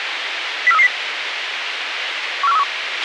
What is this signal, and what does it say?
Five-tone selective call (EEA), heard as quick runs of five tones, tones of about 40 ms, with radio hiss and a squelch burst at the end. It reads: 04330 14131